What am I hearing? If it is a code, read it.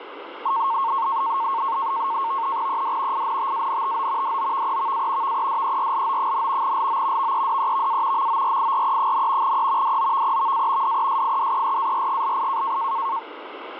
NAVTEX (SITOR-B), 100 baud, 170 Hz shift, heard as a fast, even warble, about 1000 Hz centre, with radio static. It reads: ED INTANTO DOVEVA VEDERLO, LO VEDEVA MORIRE, E DOVEVA DESIDERARGLI